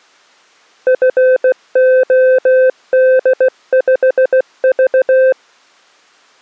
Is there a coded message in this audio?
Yes: Morse code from 0.8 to 5.4 s, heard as a keyed tone, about 16 wpm, 520 Hz. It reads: FOD5V